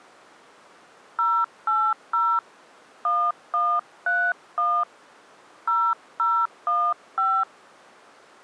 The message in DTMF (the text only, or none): 080 1131 0015